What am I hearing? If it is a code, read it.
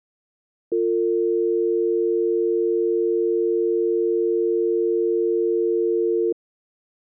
Telephone call progress tone (North American or UK plan), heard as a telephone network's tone, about 350, 450 Hz. Dial tone.